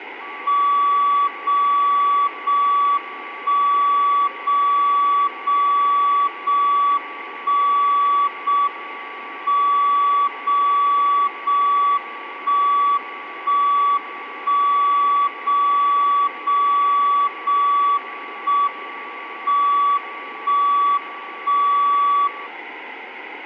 Radio time signal (JJY), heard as a tone whose level steps once a second, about 1140 Hz, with room echo. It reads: 0 0 1 0 0 0 1 0 M 0 0 1 1 1 0 0 0 1 M 1 1 0